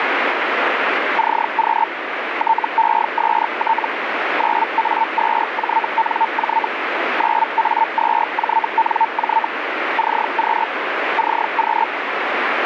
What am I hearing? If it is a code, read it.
Hellschreiber (Feld-Hell, 122.5 baud), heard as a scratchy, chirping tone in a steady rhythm, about 900 Hz, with radio static. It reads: CQ TEST 9A2JNJ 9A2JNJ CQ CQ